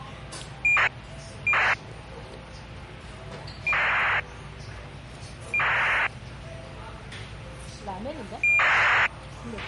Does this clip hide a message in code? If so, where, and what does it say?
Yes: ACARS aircraft data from 0.6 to 9.1 s, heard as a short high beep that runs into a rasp, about 2400 baud, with a squelch burst at the end and the noise of a restaurant.